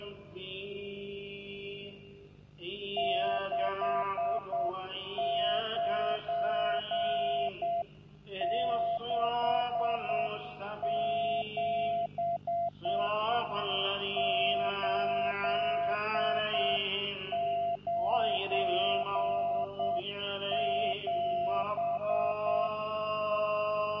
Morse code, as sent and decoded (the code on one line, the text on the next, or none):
-.... ----. -.... --... / ---.. ----. --...
6967 897